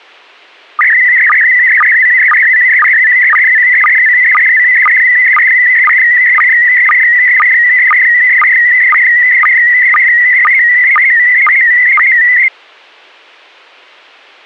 SSTV (slow-scan television), PD 120, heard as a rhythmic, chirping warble.